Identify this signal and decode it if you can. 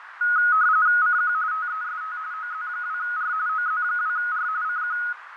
RTTY (45.45 baud, 170 Hz shift), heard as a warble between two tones, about 1360 Hz centre, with radio static, fading and a narrow filter. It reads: CQ TEST OZ2R OZ2R CQ